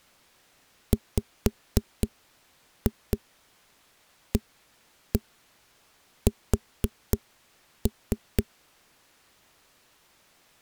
Tap code, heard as knocks on a wall, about 4 knocks a second. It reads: WAS